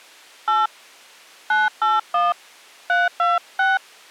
DTMF, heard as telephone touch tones, dialled by hand, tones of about 180 ms. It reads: 8 981 326